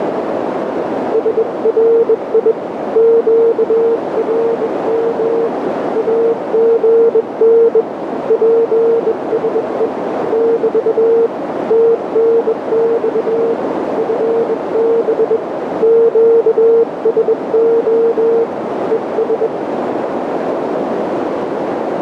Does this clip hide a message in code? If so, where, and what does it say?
Yes: Morse code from 1.1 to 19.5 s, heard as a keyed tone, hand-sent with a bug key, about 21 wpm, 460 Hz, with heavy radio static and a narrow filter. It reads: SRI QRM AGN PSE <BT> TNX FB QSO ES